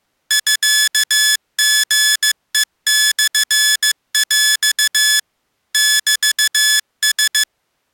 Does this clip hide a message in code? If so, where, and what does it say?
Yes: Morse code (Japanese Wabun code) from 0.2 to 7.5 s, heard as electronic beeps, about 15 wpm, 1700 Hz. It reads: ミリヘモヰ メラ